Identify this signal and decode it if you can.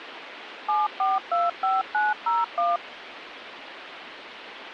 DTMF, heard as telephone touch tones, dialled by machine, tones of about 180 ms, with phone line noise. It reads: 7425901